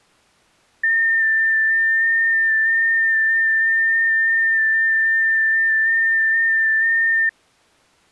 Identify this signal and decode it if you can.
FT8 (one signal), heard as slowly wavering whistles, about 6.25 baud.